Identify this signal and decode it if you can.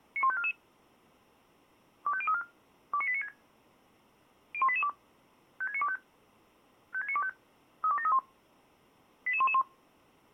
Five-tone selective call (ZVEI), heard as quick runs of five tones, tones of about 70 ms. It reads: 91544 25034 29896 01882 56925 56925 32731 88111